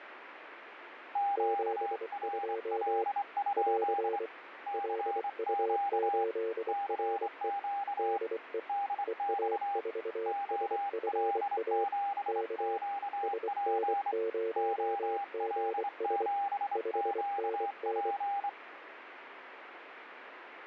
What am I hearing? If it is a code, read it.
Morse code, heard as two keyed tones, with radio static. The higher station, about 25 wpm, 800 Hz: QRL? CQ CQ DX OL7QP OL7QP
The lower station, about 24 wpm, 450 Hz: 72 <AR> LU8RE DE EA4SFA K SN0GS 5NN